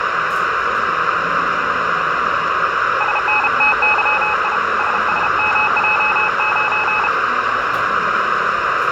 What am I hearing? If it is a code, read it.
Morse code, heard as a keyed tone, hand-sent with a paddle, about 33 wpm, 850 Hz, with radio static, room echo and the noise of a restaurant. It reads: SNTYI SSMJ9